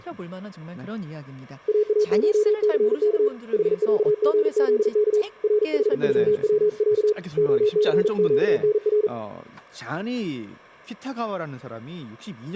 Morse code (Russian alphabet), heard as a keyed tone, hand-sent with a paddle, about 40 wpm, 420 Hz, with speech in Korean. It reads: ААШЦК ХЯГЗК РХЮВЯ ОЦЩНР